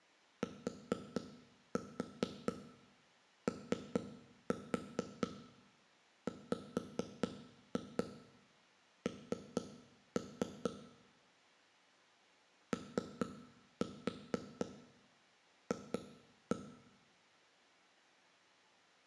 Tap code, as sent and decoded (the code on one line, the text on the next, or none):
4-4 3-4 5-2 3-3 / 3-4 2-1
TOWN OF